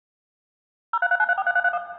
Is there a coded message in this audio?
Yes: DTMF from 0.9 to 1.8 s, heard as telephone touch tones, dialled by machine, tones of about 40 ms, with room echo. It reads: 0339343331